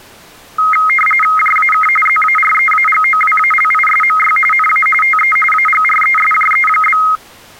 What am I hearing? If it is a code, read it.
RTTY (45.45 baud, 850 Hz shift), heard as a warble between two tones, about 1700 Hz centre. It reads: JAK ZAREAGOWALISMY NA TE AGRESJE?